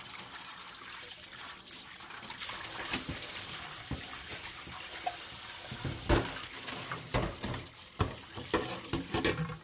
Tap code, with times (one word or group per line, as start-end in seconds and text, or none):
none